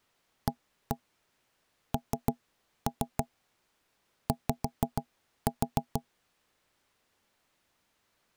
Tap code, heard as knocks on wood, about 6 knocks a second. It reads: ANY